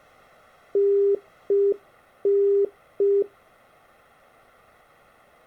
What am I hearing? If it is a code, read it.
Telephone call progress tone (UK plan), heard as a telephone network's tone, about 400 Hz. Congestion tone.